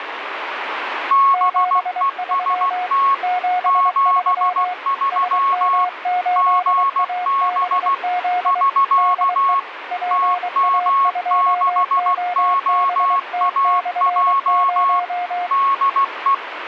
Morse code, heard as two keyed tones, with radio static. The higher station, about 16 wpm, 1100 Hz: BEST 73 GB <SK> TM6OAJ DE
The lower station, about 23 wpm, 720 Hz: 73 73 SM8ABZ DE PA2OBT/0